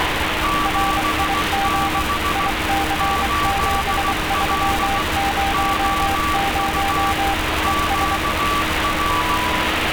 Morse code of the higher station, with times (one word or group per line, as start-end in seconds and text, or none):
0.4-2.5 76
3.0-5.0 8L
5.5-7.1 OU
7.6-9.4 QR